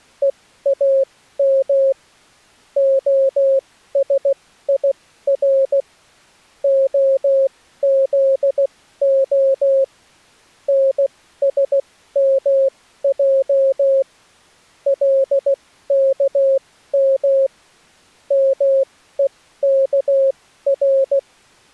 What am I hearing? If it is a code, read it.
Morse code (Hebrew alphabet), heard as a keyed tone, machine-sent, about 16 wpm, spaced as for 13 wpm, 540 Hz. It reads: ואם השיר הזה נשמע לכם מוכר